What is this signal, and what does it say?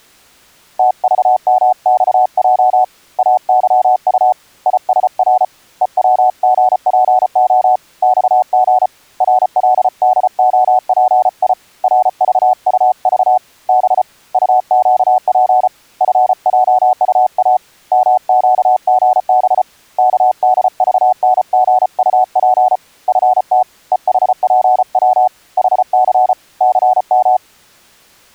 Morse code, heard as a keyed tone, hand-sent with a paddle, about 34 wpm, 740 Hz. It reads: TVMXJ AYU ISR EWGPO XG RLDOPI RVUV B UQP FJUA MQGB KDVNGUP FT EHPW HC CM